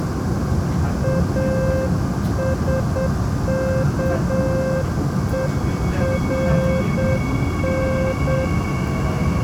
Morse code, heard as a keyed tone, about 8 wpm, 530 Hz, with the noise inside a subway train. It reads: ASKERN